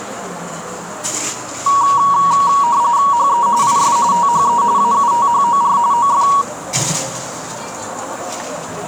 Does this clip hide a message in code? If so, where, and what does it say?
Yes: RTTY (45.45 baud, 170 Hz shift) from 1.7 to 6.4 s, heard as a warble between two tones, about 1030 Hz centre, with radio static and the noise of a cafe. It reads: HE IS THE AUTHOR OF